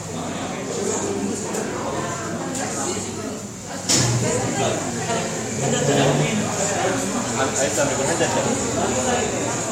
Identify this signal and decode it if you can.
The noise of a cafe. There is no code.